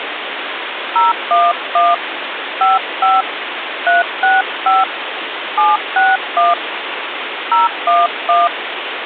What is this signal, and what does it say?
DTMF, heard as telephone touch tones, dialled by hand, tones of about 180 ms, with phone line noise. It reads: 011 55 365 761 011